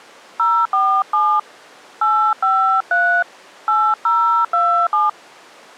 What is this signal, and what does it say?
DTMF, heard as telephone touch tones, dialled by hand, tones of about 280 ms. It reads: 047 853 8027